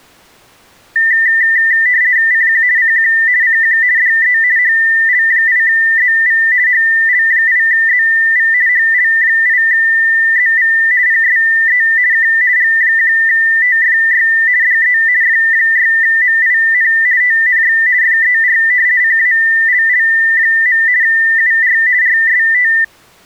RTTY (50 baud, 170 Hz shift), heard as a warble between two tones, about 1900 Hz centre. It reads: CQ CQ CQ DE HL8ZV HL8ZV HL8ZV PSE K G1TFY DE F6MIN TNX FER CALL. UR RST